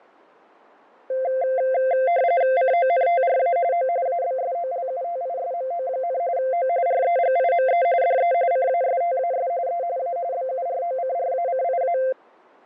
RTTY (45.45 baud, 170 Hz shift), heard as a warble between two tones, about 610 Hz centre, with fading. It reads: CONTRA O ABSOLUTISMO, O REGIME DE CASTAS E A BUROCRACIA